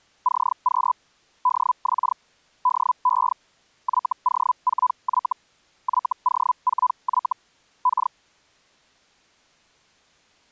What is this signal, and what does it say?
Hellschreiber (Feld-Hell, 122.5 baud), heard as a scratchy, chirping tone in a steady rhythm, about 1000 Hz. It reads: CQ DX DE YO4Y YO4Y K